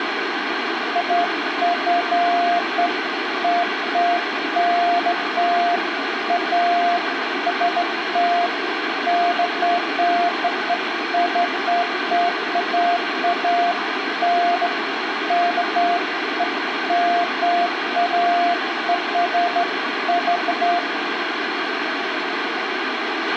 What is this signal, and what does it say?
Beeps of irregular length, with radio hiss and a squelch burst at the end. There is no code.